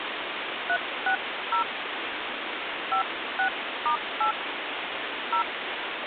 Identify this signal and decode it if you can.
DTMF, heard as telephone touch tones, dialled by hand, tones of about 90 ms, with phone line noise. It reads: 360 56*8 0